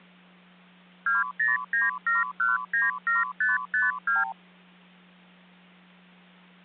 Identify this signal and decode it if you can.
Multi-frequency trunk signalling (R2, with the far end's replies), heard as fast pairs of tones, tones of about 170 ms, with hum. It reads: 2097197552